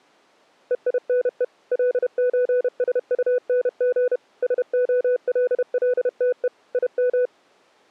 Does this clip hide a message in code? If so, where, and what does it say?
Yes: Morse code (with German letters) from 0.6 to 7.3 s, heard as a keyed tone, machine-sent, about 31 wpm, 500 Hz. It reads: EINE LÖSUNG SOLLTE IM